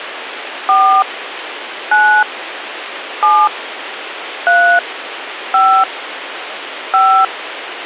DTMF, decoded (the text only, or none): 4 9 7 3 5 5